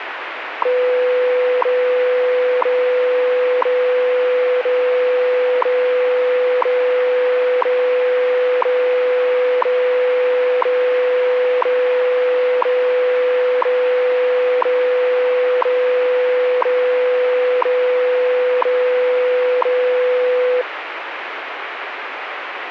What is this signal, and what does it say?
Radio time signal (WWV, Colorado), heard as ticks, one a second, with radio static.